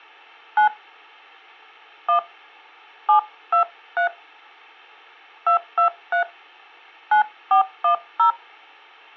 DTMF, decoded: 9 1 723 223 9410

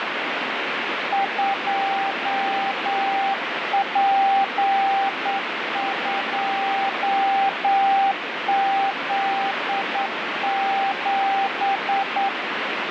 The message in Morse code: 2P2Z7

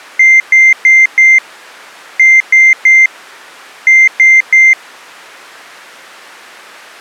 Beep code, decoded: 4-3-3

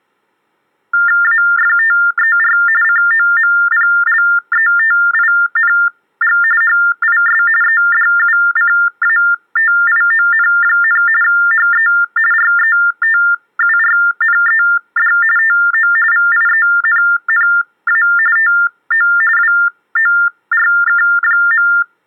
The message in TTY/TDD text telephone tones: AFTER COMPLETING HIS EDUCATION, HE RETURNED TO VIENNA TO WORK.

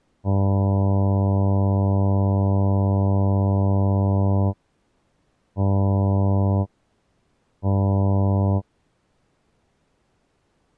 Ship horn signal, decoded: 1 long, 2 short

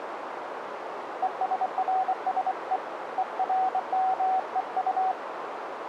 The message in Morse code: ESRSE ERMEU

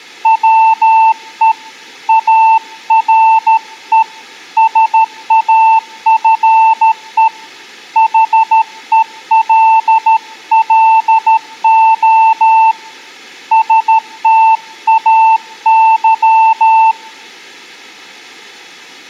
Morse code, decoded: WE ARE SAFE HELLO STAY

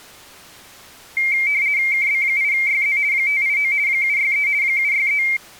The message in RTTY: KB8YZ 589 763 763

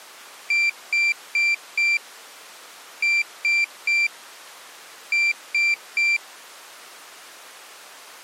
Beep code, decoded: 4-3-3

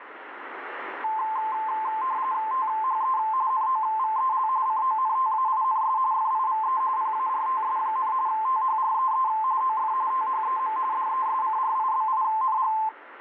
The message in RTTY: THE NOVEL CONTAINS FIVE PARTS, THREE OF THEM DESCRIBING

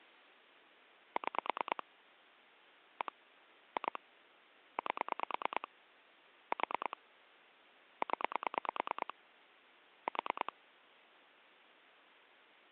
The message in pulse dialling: 6 1 2 8 4 0 4

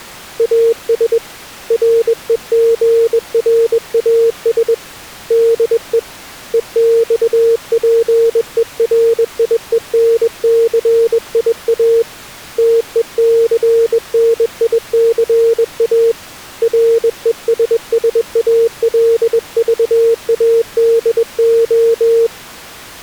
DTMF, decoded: none

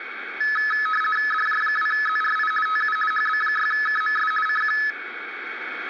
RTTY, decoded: DJ2ZRI TU HB6KMS CQ

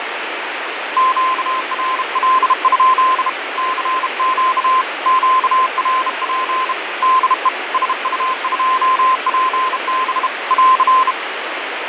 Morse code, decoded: QRL? CQ QRP DE SU2PB <AR>

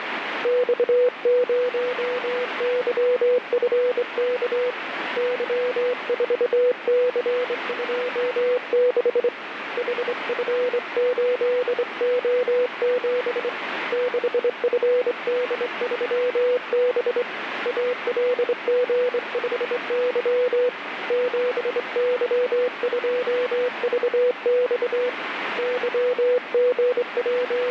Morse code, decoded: X0YFK Y4C26 HF8O7 6FD3B ALG5Y 7Y2VX …

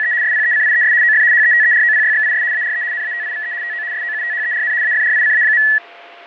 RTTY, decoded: … SPECIES OF HETEROPYXIS ARE NATIVE TO SOUTHERN AFRICA.

